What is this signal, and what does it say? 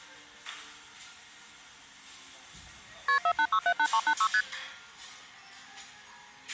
Multi-frequency trunk signalling (R1, as on North American trunks), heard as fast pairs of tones, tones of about 70 ms, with the noise of a cafe. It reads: KP 48678386 ST